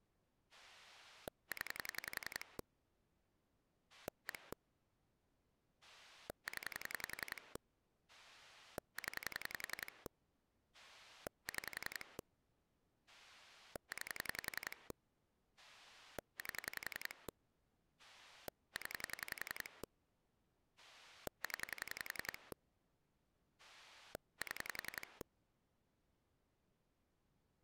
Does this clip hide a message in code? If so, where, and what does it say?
Yes: pulse dialling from 0.5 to 25.2 s, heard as a rotary dial, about 11 pulses a second. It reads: 0 1 0 0 6 9 8 0 0 7